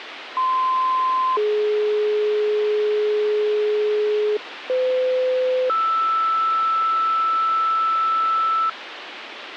Two-tone page, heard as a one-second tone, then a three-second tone, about 1040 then 420 Hz, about 510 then 1320 Hz, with radio hiss.